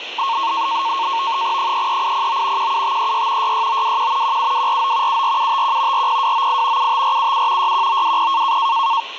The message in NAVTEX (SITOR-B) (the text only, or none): 33809 17536 66921 17249 74751 40298 75477 61920